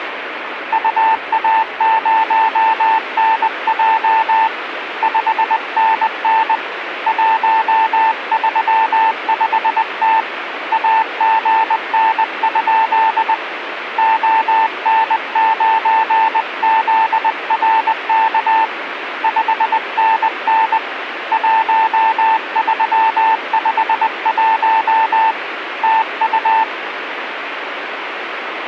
Morse code, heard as a keyed tone, hand-sent with a paddle, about 20 wpm, 890 Hz, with radio static. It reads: UA0NJ 5NN 135T AGN? ON9ZRK 5NN 1351 TU